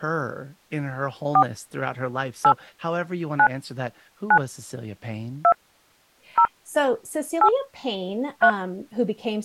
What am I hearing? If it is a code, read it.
DTMF, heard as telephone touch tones, dialled by hand, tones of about 70 ms, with speech in English. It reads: 4 8 9 9 2 0 8 3